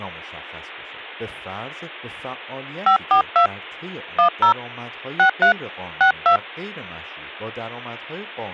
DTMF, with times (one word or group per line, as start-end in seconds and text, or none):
2.9-3.5 542
4.2-4.5 10
5.2-5.5 63
6.0-6.4 62